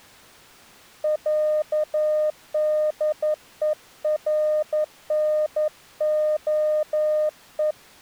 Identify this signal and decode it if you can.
Morse code (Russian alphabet), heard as a keyed tone, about 11 wpm, 610 Hz. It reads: ЯДЕРНОЕ